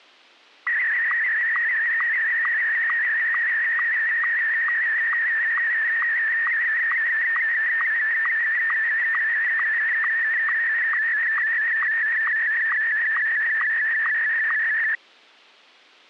SSTV (slow-scan television), Martin M1, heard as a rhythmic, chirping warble.